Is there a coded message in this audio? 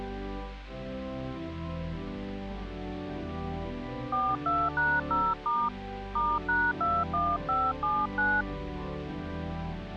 Yes: DTMF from 4.1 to 8.4 s, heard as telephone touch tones, dialled by hand, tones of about 230 ms. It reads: 42#0* *#21579